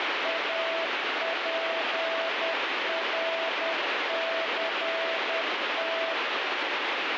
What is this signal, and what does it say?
Morse code, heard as a keyed tone, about 10 wpm, 660 Hz, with heavy radio static. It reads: APRCT